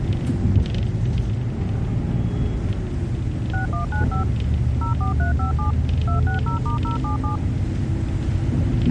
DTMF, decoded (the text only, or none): 6195 04357 260*077